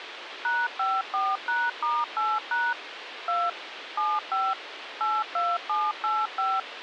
DTMF, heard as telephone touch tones, dialled by machine, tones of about 220 ms, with radio hiss. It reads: #54#*8# 2 75 82785